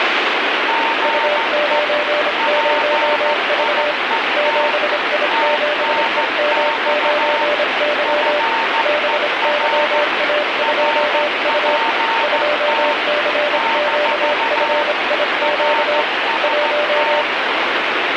Morse code, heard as two keyed tones, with heavy radio static. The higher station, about 14 wpm, 910 Hz: GE PIET TNX FER RPT - RST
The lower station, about 26 wpm, 590 Hz: U90V 7I7EM9Y BYA2U 2CQFIQ 1